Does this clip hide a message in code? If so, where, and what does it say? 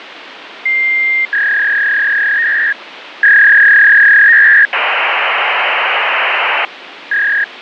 Yes: fax machine handshake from 0.7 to 7.4 s, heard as a long tone, a warble and hiss, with phone line noise.